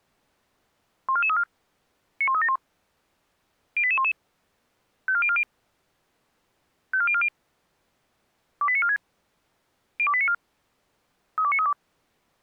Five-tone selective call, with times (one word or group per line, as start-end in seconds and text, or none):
1.1-1.4 14434
2.2-2.6 91371
3.8-4.1 08811
5.1-5.4 54040
6.9-7.3 54040
8.6-9.0 28946
10.0-10.3 02894
11.4-11.7 32932